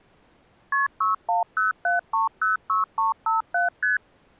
Multi-frequency trunk signalling (R1, as on North American trunks), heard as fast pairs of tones, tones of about 140 ms. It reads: KP 6107306357 ST